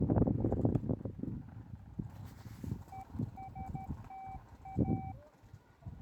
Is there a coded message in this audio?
Yes: Morse code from 2.9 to 5.2 s, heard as a keyed tone, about 13 wpm, 770 Hz, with the noise of a park. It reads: ESTA